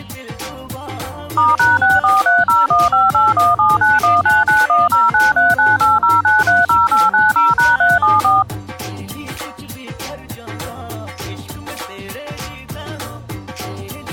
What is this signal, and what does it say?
DTMF, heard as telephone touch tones, dialled by machine, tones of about 180 ms. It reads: *#64301581791991093980930890#374